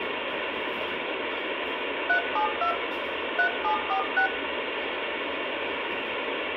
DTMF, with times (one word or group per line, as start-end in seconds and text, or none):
2.1-2.7 372
3.4-4.3 3746